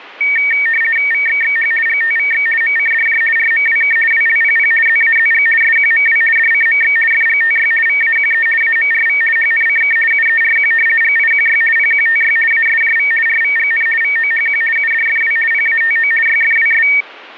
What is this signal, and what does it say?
RTTY (50 baud, 450 Hz shift), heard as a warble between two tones, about 2050 Hz centre. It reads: VXXH GTVX MCDJ RMWK WLPP ZAZG SQMW DCMX FGTY VAQE AMRV HNCK UERQ GIQY PQTY ASJV RVGN VOHQ UDFW PATO YFWS